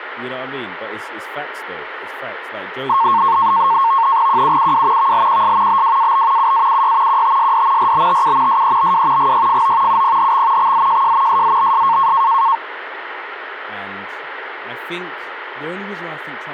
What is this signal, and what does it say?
NAVTEX (SITOR-B), 100 baud, 170 Hz shift, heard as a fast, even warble, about 1000 Hz centre, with radio static and speech in English. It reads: QUUW VLQS BWAB UAUY QTSD RBTU SEBW GYFO UPHX XZJJ SZBS